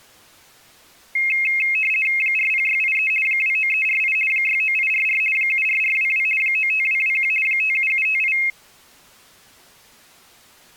RTTY (50 baud, 450 Hz shift), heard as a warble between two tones, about 2350 Hz centre. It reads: 40683 29348 69844 74422 95221 57758